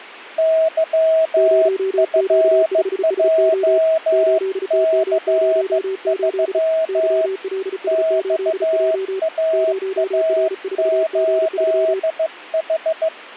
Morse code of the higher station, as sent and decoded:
-.-- ..-. .--- -.-. ...-- / -..- .- .- ---.. ....
YFJC3 XAA8H

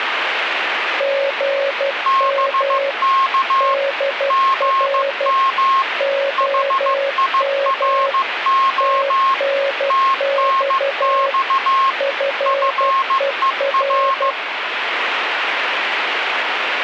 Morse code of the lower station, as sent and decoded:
--. -- / -.. .-. / --- -- / - -. -..- / ..-. . .-.
GM DR OM TNX FER

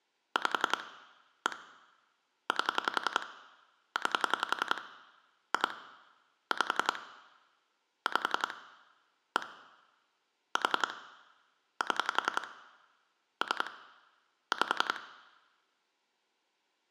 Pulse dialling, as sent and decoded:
5 / 1 / 8 / 9 / 2 / 5 / 5 / 1 / 4 / 7 / 3 / 5
5 1 8 9 2 5 5 1 4 7 3 5

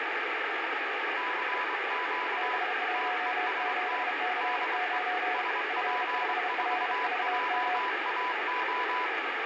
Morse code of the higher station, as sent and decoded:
-.-. --.- / - . ... - / -.. . / ... .--. ....- .--- .- ---
CQ TEST DE SP4JAO

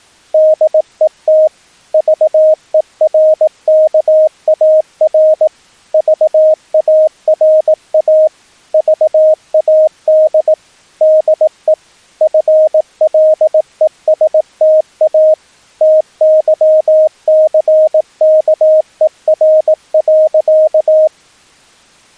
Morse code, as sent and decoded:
-.. . - / ...- . .-. -.- .- .-. / ...- .- .-. .- / ...- .- -.. / -.. . / ..-. .-.. . ... - .- / - -.-- -.-. -.- . .-. .-.-.-
DET VERKAR VARA VAD DE FLESTA TYCKER.

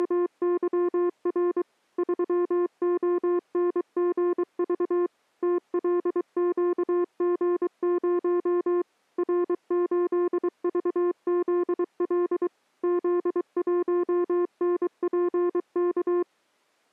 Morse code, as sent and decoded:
… / ...-- --- -. --. ...- / - .-.. --.- --. ----- / .-. ---.. ...- --.. .-.. / --.. .---- -. .--. -.-
… 3ONGV TLQG0 R8VZL Z1NPK

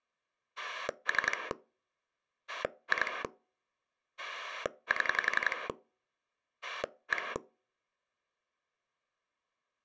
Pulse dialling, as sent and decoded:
3 / 2 / 7 / 1
3 2 7 1

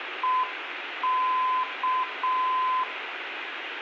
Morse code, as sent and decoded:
. -.-
EK

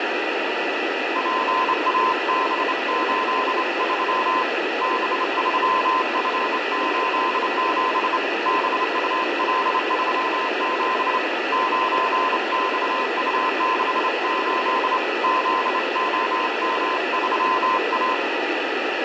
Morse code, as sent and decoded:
.--. .- -... ---.. ...-- / -... ...-- ..-. ---.. --... / -... ..- .-.. ...-- --... / ----. -..- ..- -.... ---.. / --.. --- -- ...-- .-
PAB83 B3F87 BUL37 9XU68 ZOM3A

